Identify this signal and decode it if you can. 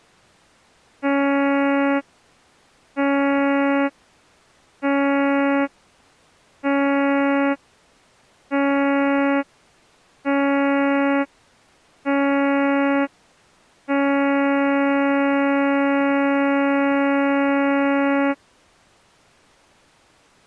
Ship horn signal, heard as a ship's horn, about 280 Hz. 7 short, 1 long. At sea: general emergency alarm.